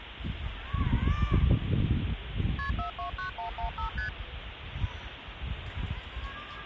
Multi-frequency trunk signalling (R1, as on North American trunks), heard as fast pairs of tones, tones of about 110 ms, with phone line noise and the noise of a park. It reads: KP 429115 ST